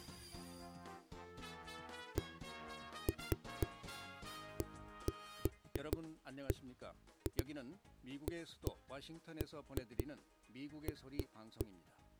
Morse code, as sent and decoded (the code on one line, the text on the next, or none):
none